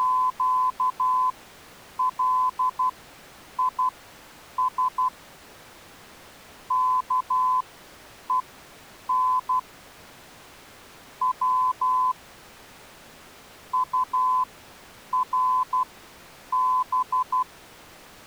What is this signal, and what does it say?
Morse code (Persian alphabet), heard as a keyed tone, machine-sent, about 12 wpm, spaced as for 8 wpm, 1020 Hz. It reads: … کهن و طرب